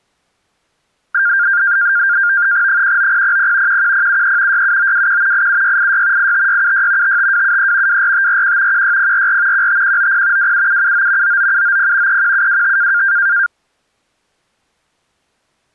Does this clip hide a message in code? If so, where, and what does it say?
Yes: NAVTEX (SITOR-B), 100 baud, 170 Hz shift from 1.1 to 13.5 s, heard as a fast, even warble, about 1500 Hz centre. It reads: 19000 11073 67921 87686 85676 55273 24541 16044 15190 27779 99790 31725